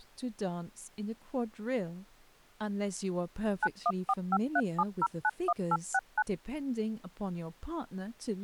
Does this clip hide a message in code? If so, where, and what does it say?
Yes: DTMF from 3.6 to 6.2 s, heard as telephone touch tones, dialled by machine, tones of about 50 ms, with speech in English. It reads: 914537091869